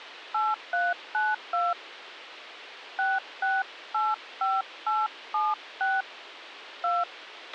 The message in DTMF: 8392 6685876 2

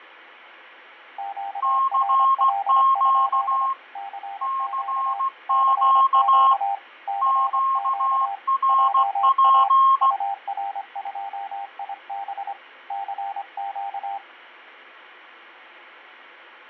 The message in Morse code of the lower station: QRL? CQ CQ CQ JA UR2IB CQ

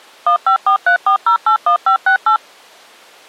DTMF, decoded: 15434081568

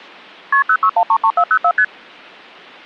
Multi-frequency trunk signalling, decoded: KP 06133404 ST

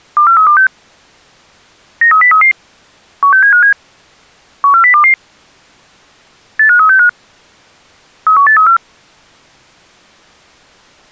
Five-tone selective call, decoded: 24326 93033 16757 14022 85365 31834

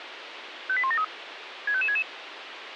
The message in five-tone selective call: 58173 65566

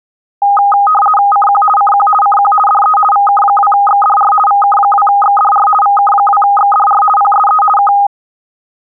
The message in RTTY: CQ CQ CQ DE VK2XDR VK2XDR VK2XDR PSE K

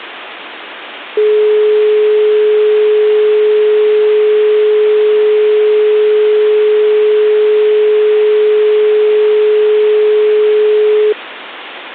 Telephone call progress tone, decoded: dial tone

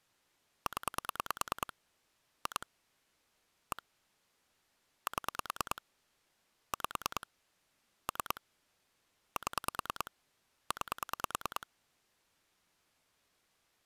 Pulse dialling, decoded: 0 2 1 7 5 3 7 9

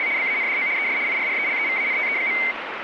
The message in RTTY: … BANDO ES IRRELEVANTE.

